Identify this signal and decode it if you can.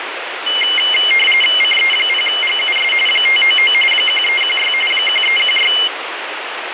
RTTY (45.45 baud, 850 Hz shift), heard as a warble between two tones, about 2550 Hz centre, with radio static. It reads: CE0GUS 599 1316 1316